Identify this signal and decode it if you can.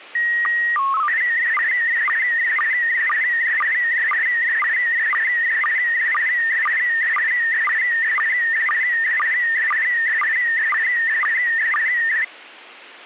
SSTV (slow-scan television), PD 120, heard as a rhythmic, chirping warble.